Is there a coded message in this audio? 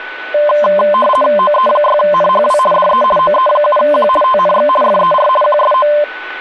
Yes: RTTY (50 baud, 450 Hz shift) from 0.3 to 6.0 s, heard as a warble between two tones, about 820 Hz centre, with a steady whistle near 1490 Hz and speech in Assamese. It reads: OE6NHW DE OE7Q TNX FER QSO